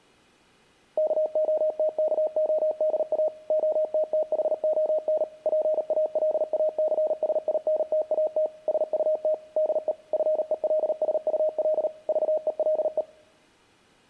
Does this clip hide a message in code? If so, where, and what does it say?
Yes: Morse code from 0.9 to 13.1 s, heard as a keyed tone, machine-sent, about 38 wpm, 620 Hz. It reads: KOTKODA OTTHON PALACSINTAT SUT DE FELSUL VELE